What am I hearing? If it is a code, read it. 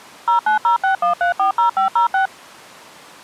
DTMF, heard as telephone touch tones, dialled by machine, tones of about 120 ms. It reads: 09061340506